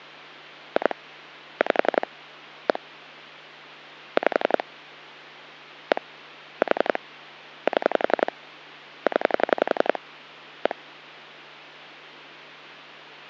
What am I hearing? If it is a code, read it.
Pulse dialling, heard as clicks on a phone line, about 11 pulses a second, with hum. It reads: 2 5 1 5 1 4 7 0 1